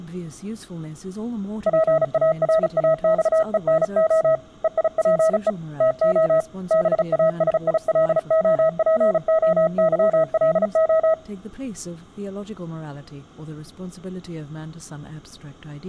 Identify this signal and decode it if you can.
Morse code (Greek alphabet), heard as a keyed tone, hand-sent with a paddle, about 35 wpm, 640 Hz, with speech in English. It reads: ΠΑΡΑΞΕΝΟ ΕΙΠΕ ΤΟ ΒΑΣΙΛΟΠΟΥΛΟ